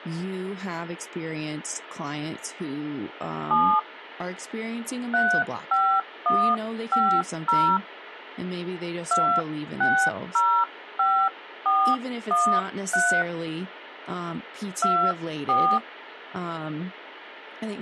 DTMF, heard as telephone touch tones, dialled by hand, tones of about 290 ms, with speech in English. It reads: 7 35150 2605413 24